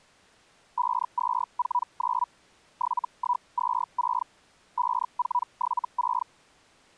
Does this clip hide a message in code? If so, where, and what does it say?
Yes: Hellschreiber (Feld-Hell, 122.5 baud) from 0.8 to 6.3 s, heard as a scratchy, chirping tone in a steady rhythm, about 980 Hz. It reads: 5249 7126 5476